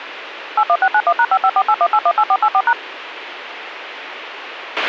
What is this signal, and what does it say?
DTMF, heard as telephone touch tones, dialled by machine, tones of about 60 ms, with radio hiss and a squelch burst at the end. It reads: 81691#55481818484#